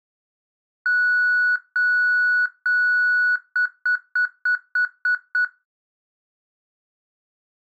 Beep code, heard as beeps, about 1470 Hz. 3 long, 7 short.